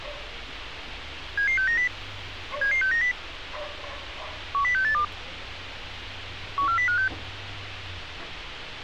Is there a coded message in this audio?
Yes: five-tone selective call (CCIR) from 1.4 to 7.1 s, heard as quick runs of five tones, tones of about 100 ms, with radio hiss and street noise. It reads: 77690 77690 10682 14056